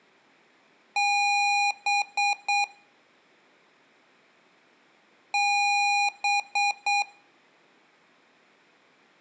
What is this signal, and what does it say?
Beep code, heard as beeps from a small speaker, played twice, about 810 Hz, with room echo. 1 long, 3 short. In Award and IBM BIOS tables: video adapter failure; in AMI BIOS tables: memory failure.